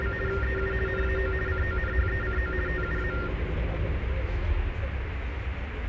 RTTY (50 baud, 450 Hz shift), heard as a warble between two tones, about 1600 Hz centre, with radio static and the noise inside a bus. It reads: … EU NAO CONHECO TUA